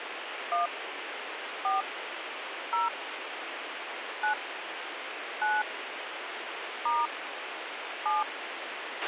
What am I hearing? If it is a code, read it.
DTMF, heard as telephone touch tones, dialled by hand, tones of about 140 ms, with radio hiss and a squelch burst at the end. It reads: 1 4 0 9 9 * 7